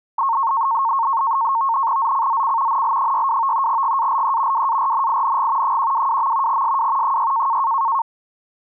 NAVTEX (SITOR-B), 100 baud, 170 Hz shift, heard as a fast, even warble, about 1000 Hz centre. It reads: ZCZC NL62 GALE WARNING 122. SW 6